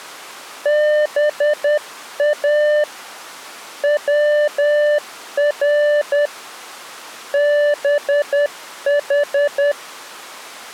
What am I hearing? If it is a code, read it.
Morse code (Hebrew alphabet), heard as a keyed tone, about 10 wpm, 590 Hz. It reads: בא צר בח